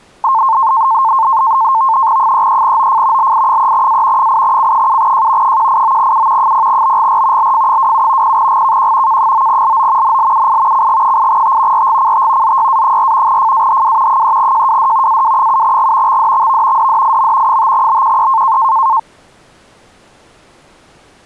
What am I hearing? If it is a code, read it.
NAVTEX (SITOR-B), 100 baud, 170 Hz shift, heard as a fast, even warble, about 980 Hz centre. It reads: 33OF LI3A 8C7J 189U 0BGR LF27 0GKQ K9LO NLUI CG8T RGCT ZYA4 FAHW 3JWD AW7G XDXV DDIM 5BQE